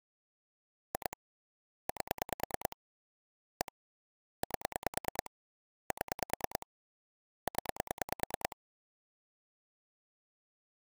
Pulse dialling, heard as clicks on a phone line, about 9 pulses a second. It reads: 2 8 1 8 7 0